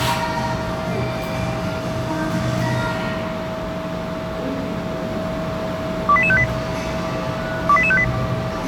Five-tone selective call (ZVEI), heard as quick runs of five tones, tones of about 70 ms, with the noise of a cafe. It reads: 28858 28858